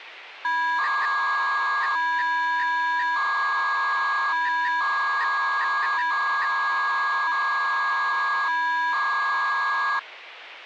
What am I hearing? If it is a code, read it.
300-baud modem data (V.21 tones), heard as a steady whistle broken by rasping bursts, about 300 baud, 200 Hz shift.